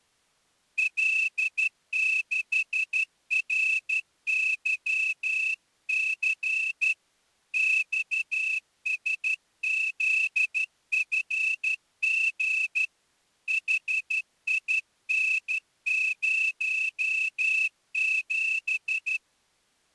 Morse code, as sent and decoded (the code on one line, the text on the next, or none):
.-.. -.... .-. -.-- -.-. / -..- ... --.. ..-. --. / .... .. -. ----- --...
L6RYC XSZFG HIN07